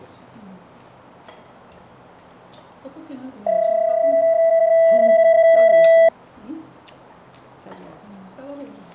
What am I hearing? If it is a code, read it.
PSK31 (31.25 baud), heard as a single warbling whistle, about 660 Hz, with the noise of a restaurant.